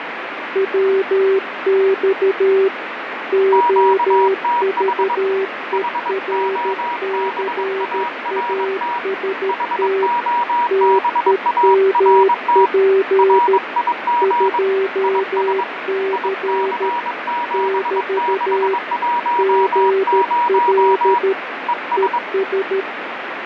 Morse code, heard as two keyed tones, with radio static and fading. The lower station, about 13 wpm, 390 Hz: WX OVERCAST TEMP 2C <BT> GL ES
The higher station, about 22 wpm, 960 Hz: QTH HOBART HOBART RIG IS IC7610 ES